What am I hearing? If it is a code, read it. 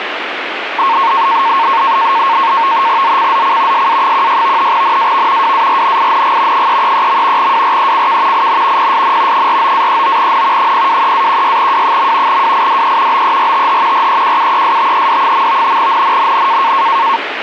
NAVTEX (SITOR-B), 100 baud, 170 Hz shift, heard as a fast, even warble, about 1000 Hz centre, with radio static. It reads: ZCZC SA16 NAV WARNING 333. WRECK IN PSN 49-39N 023-16W. WIDE BERTH REQUESTED. NNNN